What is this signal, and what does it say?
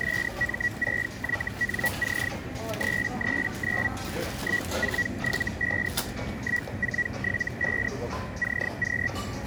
Hellschreiber (Feld-Hell, 122.5 baud), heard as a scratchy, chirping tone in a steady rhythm, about 1950 Hz, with radio static, a narrow filter and the noise of a crowd indoors. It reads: SM6YNC 339 1475 1475 CQ